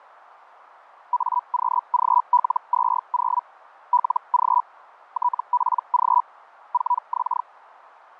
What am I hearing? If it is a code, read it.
Hellschreiber (Feld-Hell, 122.5 baud), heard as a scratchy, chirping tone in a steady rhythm, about 980 Hz, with radio static. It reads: AQGL20 LG TPG 4X